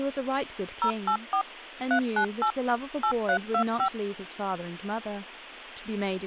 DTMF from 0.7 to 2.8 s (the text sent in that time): 084 398